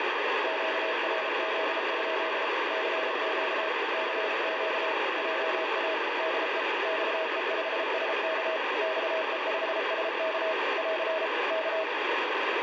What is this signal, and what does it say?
Morse code, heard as a keyed tone, machine-sent, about 33 wpm, 640 Hz, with heavy radio static. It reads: QRZ? CQ CQ JA DE XE5SK XE5SK <AR> K